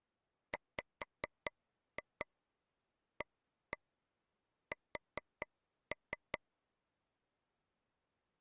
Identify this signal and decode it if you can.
Tap code, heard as taps on a table, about 4 knocks a second. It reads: WAS